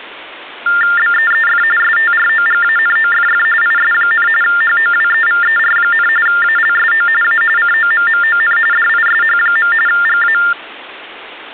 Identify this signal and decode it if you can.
TTY/TDD text telephone tones (45.45 baud Baudot), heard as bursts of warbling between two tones, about 400 Hz shift, 1600 Hz centre. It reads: BEEF STROGANOFF IS, HOWEVER, ALSO A COMMON DISH. GA